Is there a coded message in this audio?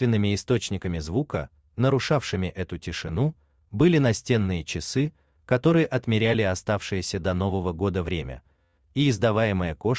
No.